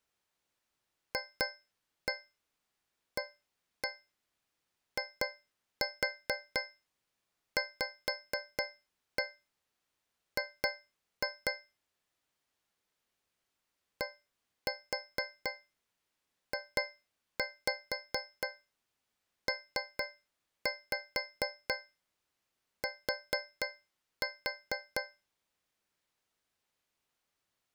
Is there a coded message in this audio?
Yes: tap code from 1.1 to 25.3 s, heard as taps on a metal pipe, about 4 knocks a second. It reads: FAIVG DJPT